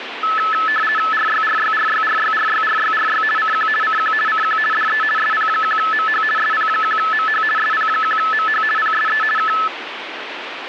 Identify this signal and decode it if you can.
RTTY (50 baud, 450 Hz shift), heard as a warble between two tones, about 1500 Hz centre, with radio static. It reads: RYRYRYRYRYRYRY CQ CQ CQ DE SP1MH SP1MH SP1MH PSE K